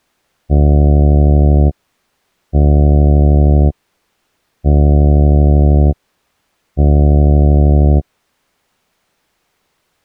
Ship horn signal, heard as a ship's horn, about 70 Hz. 4 short. At sea: a pilot vessel's identity signal in fog.